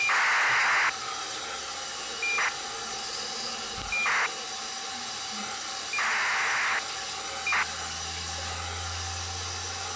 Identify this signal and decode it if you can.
ACARS aircraft data, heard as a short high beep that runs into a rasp, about 2400 baud, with the noise of a restroom.